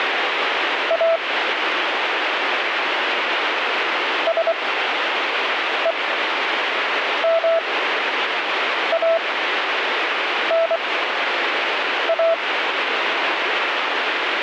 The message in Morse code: A SEMANA

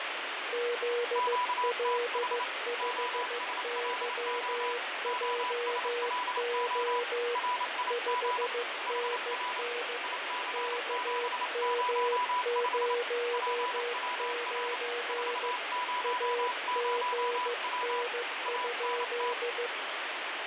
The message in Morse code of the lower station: ZL5YJO 5NN KM09 AGN?

